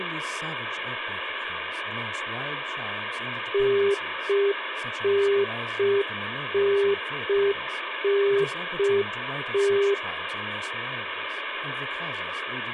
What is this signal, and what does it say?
Telephone call progress tone (UK plan), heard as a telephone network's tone, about 400 Hz, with phone line noise and speech in English. Congestion tone.